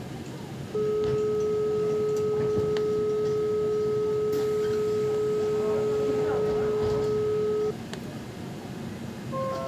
Telephone call progress tone (425 Hz plan, as in most of Europe), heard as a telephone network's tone, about 420 Hz, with the noise inside a subway train. Dial tone.